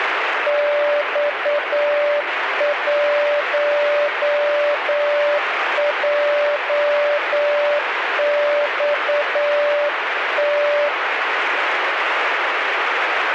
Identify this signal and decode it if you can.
Morse code, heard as a keyed tone, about 9 wpm, 580 Hz, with radio static. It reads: X1JXT